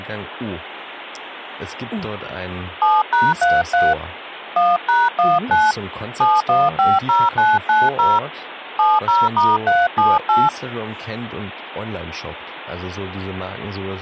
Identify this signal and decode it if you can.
DTMF, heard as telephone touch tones, dialled by hand, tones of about 200 ms, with phone line noise and speech in German. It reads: 7#33 1#19 7150990 70*378